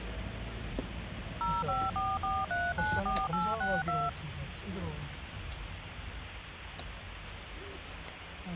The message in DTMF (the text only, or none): 0544394862